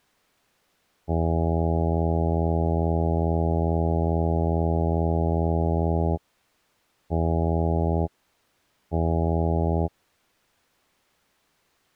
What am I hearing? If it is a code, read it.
Ship horn signal, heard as a ship's horn, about 80 Hz. 1 long, 2 short. At sea: a vessel in fog that is sailing, fishing, towing or hampered.